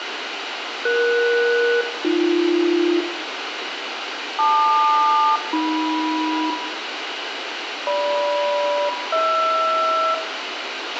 Aircraft SELCAL, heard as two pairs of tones, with radio hiss, a squelch burst at the end and room echo. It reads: ES-AB LQ-AM GM-HR